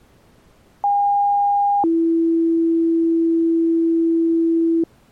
Two-tone page, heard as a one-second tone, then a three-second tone, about 810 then 330 Hz.